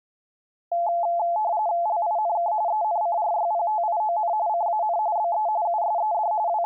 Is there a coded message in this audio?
Yes: RTTY (45.45 baud, 170 Hz shift) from 0.7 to 6.7 s, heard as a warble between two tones, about 770 Hz centre. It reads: LINK ENCRYPTION CAN BE USED …